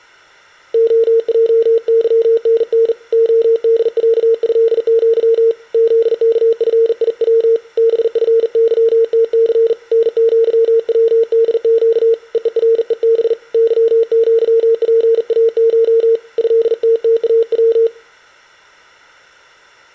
Morse code (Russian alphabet), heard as a keyed tone, hand-sent with a bug key, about 40 wpm, 460 Hz, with room echo. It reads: ОЙЫНН ОДЯЭЪ ЗКФИВ БФЫТЦ НЪВДЩ ЕЕРЕБ ЫЪПАШ ЭТТАВ